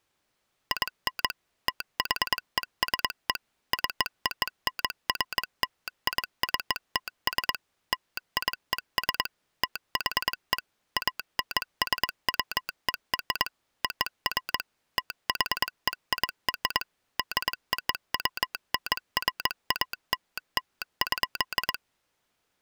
Morse code (American railroad code), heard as a telegraph sounder, machine-sent. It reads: IN THESE CONFLICTS LIES THE ANSWER OF THEIR DOWNFALL.